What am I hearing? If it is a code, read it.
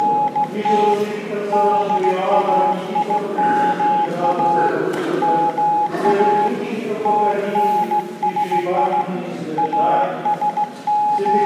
Morse code (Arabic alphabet), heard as a keyed tone, hand-sent with a straight key, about 16 wpm, 840 Hz, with room echo. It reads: … دايما ما تنسي …